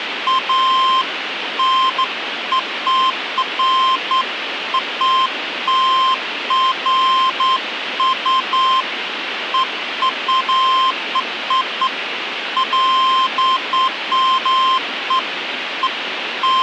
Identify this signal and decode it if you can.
Beeps of irregular length, with phone line noise. There is no code.